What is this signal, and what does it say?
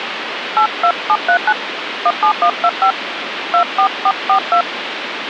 DTMF, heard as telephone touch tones, dialled by hand, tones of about 70 ms, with phone line noise. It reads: 82739 17125 24442